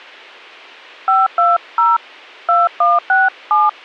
DTMF, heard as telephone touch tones, dialled by hand, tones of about 190 ms. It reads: 520 2167